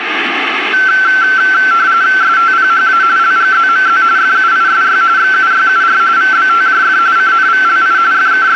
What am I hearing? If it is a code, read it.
RTTY (45.45 baud, 170 Hz shift), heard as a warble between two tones, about 1440 Hz centre, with radio static. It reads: STPHA LGZMZ FUISY XUYUR VBTJF CNVLI …